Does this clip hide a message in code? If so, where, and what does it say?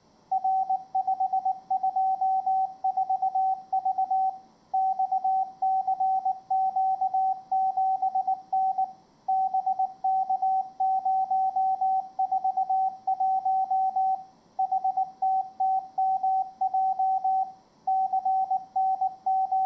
Yes: Morse code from 0.3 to 19.7 s, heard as a keyed tone, machine-sent, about 19 wpm, 760 Hz, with room echo. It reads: R524V XCQ7N BK041 HTTMJ …